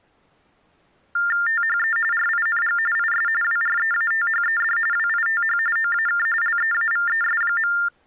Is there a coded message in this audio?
Yes: TTY/TDD text telephone tones (45.45 baud Baudot) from 1.2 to 7.9 s, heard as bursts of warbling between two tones, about 400 Hz shift, 1600 Hz centre. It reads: THE RING IS WREATHED WITH OAK LEAVES.